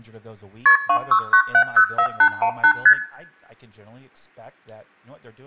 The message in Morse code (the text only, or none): none